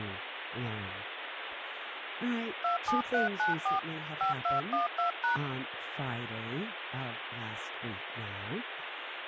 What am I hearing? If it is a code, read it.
DTMF, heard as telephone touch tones, dialled by hand, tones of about 130 ms, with phone line noise and speech in English. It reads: 27394 5212#